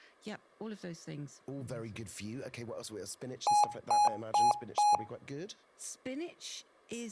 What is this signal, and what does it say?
Beep code, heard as beeps from a small speaker, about 830 Hz, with speech in English. 4 short. In AMI BIOS tables: system timer failure; in Dell tables: memory read or write failure.